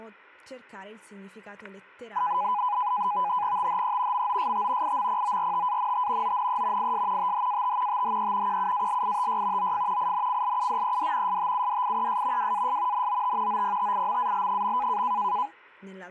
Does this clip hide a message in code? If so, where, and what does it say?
Yes: NAVTEX (SITOR-B), 100 baud, 170 Hz shift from 2.2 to 15.5 s, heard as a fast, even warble, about 910 Hz centre, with static crashes and speech in Italian. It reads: THE MOST IMPORTANT ONE IS THAT THE QUALITY OF INCLUDED STUDIES WAS NOT OPTIMAL.